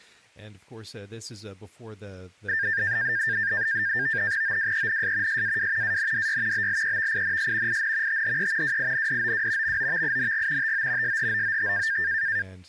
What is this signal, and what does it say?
NAVTEX (SITOR-B), 100 baud, 170 Hz shift, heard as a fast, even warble, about 1700 Hz centre, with speech in English. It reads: OWENS SAW ANDY BLEVINS IN THE WINDOW MOVING TO SHOOT